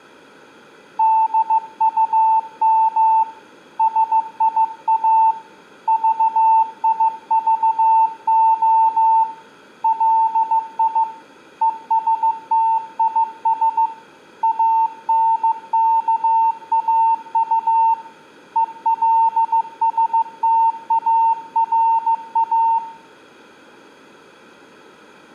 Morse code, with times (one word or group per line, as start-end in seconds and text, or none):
1.0-3.2 DUM
3.8-5.3 SIA
5.9-9.2 VIVO
9.8-11.0 LI
11.6-13.9 ESTIS
14.4-17.9 ANKAU
18.6-22.8 ELSTARA